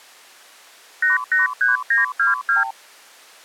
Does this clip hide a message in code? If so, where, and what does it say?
Yes: multi-frequency trunk signalling (R2, with the far end's replies) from 1.0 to 2.7 s, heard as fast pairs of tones, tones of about 150 ms. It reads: 883922